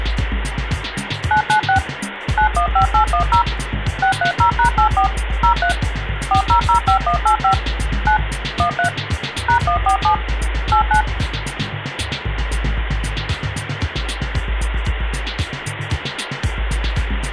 DTMF, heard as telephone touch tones, dialled by machine, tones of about 100 ms, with phone line noise. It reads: 996 915810 630#84 03 4005185 9 13 #147 89